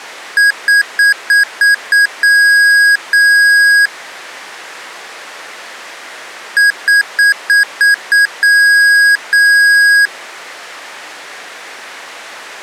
Beep code, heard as beeps from a small speaker, played twice, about 1650 Hz. 6 short, 2 long.